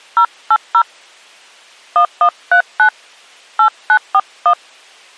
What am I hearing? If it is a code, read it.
DTMF, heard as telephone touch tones, dialled by hand, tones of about 70 ms. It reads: 080 1139 8941